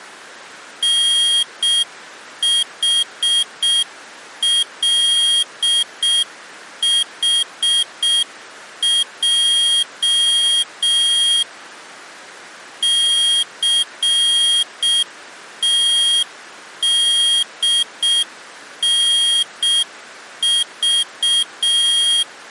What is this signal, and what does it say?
Morse code, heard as a high beeper, machine-sent, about 6 wpm, 3250 Hz. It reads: NHLHJ CTDNV